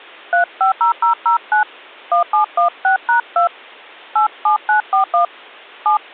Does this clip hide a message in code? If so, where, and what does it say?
Yes: DTMF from 0.3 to 6.0 s, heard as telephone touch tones, dialled by hand, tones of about 110 ms. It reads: 350009 1716#2 87941 7